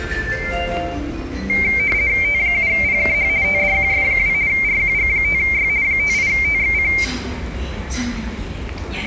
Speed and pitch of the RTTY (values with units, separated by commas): 50 baud, 170 Hz shift, 2200 Hz centre